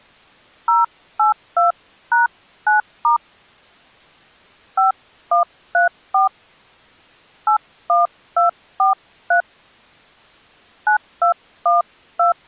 DTMF, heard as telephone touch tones, dialled by hand, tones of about 130 ms. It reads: 082#9* 5134 81243 9212